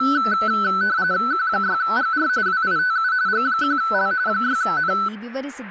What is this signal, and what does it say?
RTTY (45.45 baud, 170 Hz shift), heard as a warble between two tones, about 1410 Hz centre, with radio static and speech in Kannada. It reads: Q6GR WITU G1L 6N